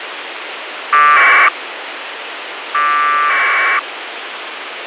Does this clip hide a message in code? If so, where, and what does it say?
Yes: packet radio (AX.25, as in APRS), 1200 baud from 0.9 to 3.8 s, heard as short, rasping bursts, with radio hiss.